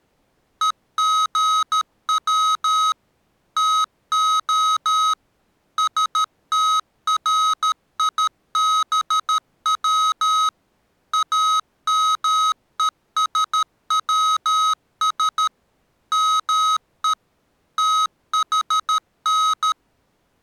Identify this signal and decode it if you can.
Morse code (Greek alphabet), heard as electronic beeps, machine-sent, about 13 wpm, 1270 Hz. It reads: ΕΓΩ ΤΟ ΣΤΡΙΒΩ ΑΜΕΣΩΣ ΜΕ ΤΗΝ